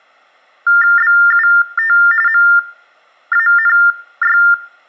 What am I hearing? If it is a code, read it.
TTY/TDD text telephone tones (45.45 baud Baudot), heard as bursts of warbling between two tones, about 400 Hz shift, 1600 Hz centre. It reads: BUT MANY